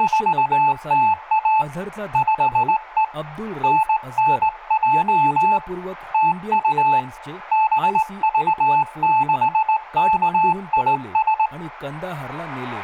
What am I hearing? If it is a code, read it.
Morse code, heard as a keyed tone, hand-sent with a straight key, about 19 wpm, 870 Hz, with room echo and speech in Marathi. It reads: … 5E NNJ TU BV6KIS